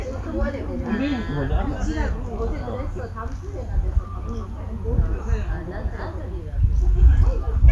The noise of a park. There is no code.